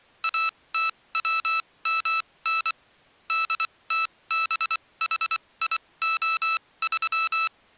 Morse code, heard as electronic beeps, machine-sent, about 24 wpm, spaced as for 19 wpm, 1320 Hz. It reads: ATWMN DTBHIO3